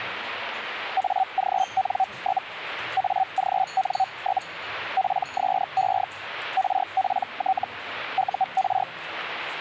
Hellschreiber (Feld-Hell, 122.5 baud), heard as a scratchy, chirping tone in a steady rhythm, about 760 Hz, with radio static and the noise of a restaurant. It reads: AGN? AGN? PSE RPT UR